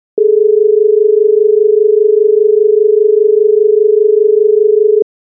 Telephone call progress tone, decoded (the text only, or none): dial tone